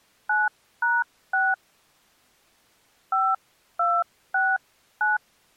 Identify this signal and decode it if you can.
DTMF, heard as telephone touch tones, dialled by hand, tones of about 240 ms. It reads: 9#6 5269